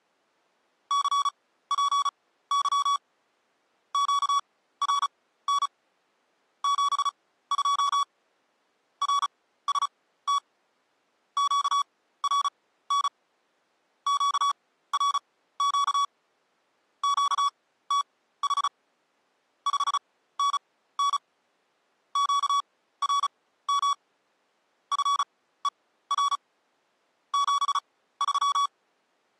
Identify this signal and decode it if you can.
Morse code, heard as electronic beeps, machine-sent, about 35 wpm, spaced as for 16 wpm, 1130 Hz. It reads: CPY QRN 72 RST QRN QRQ QTH 5NN QRM FER 73